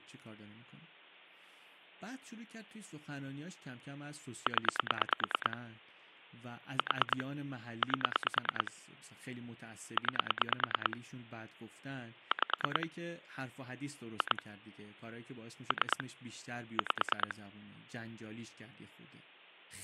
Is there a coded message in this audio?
Yes: pulse dialling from 4.5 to 17.3 s, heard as clicks on a phone line, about 9 pulses a second, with speech in Persian. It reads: 0 4 8 9 5 2 3 5